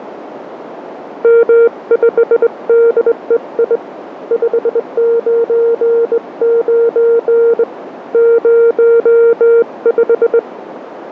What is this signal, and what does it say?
Morse code, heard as a keyed tone, hand-sent with a straight key, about 20 wpm, 460 Hz, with radio static and a narrow filter. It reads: M5DEI 599 05